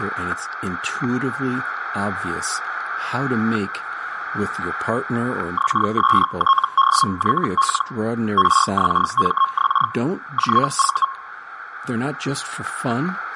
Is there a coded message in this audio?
Yes: Hellschreiber (Feld-Hell, 122.5 baud) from 5.6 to 11.1 s, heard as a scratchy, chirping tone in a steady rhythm, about 1080 Hz, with static crashes and speech in English. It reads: XSTDYL RXMX JV